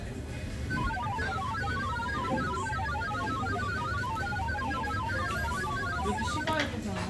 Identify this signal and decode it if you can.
Multi-tone FSK (Olivia or MFSK type), about 1000 Hz wide, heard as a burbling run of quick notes, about 31.25 baud, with the noise of a restaurant.